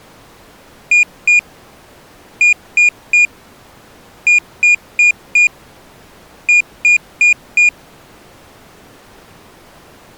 Beep code, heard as a piezo beeper, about 2450 Hz. 2-3-4-4.